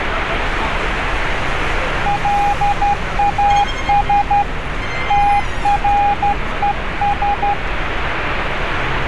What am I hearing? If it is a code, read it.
Morse code, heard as a keyed tone, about 12 wpm, 810 Hz, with radio static and street noise. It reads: LAS TRES